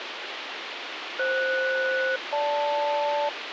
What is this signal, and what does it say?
Aircraft SELCAL, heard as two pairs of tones, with radio hiss. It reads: FS-GL